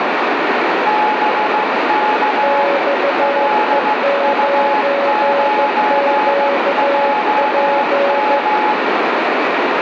Morse code, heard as two keyed tones, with heavy radio static. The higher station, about 15 wpm, 850 Hz: BK LU9JM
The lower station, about 15 wpm, 560 Hz: XE9QP